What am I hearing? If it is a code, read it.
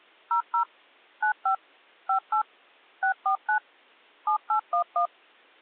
DTMF, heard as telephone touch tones, dialled by machine, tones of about 100 ms. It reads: 00 95 58 649 7811